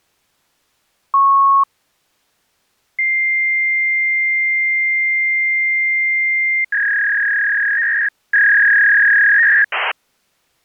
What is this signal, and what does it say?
Fax machine handshake, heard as a beep, a long tone and a warble.